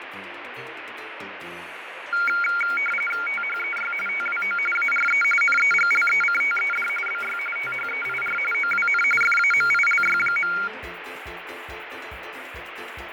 RTTY (45.45 baud, 850 Hz shift), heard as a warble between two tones, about 1800 Hz centre, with radio static and fading. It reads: THEY TWO ARE NEGLECTED BY THEIR OWN FAMILY.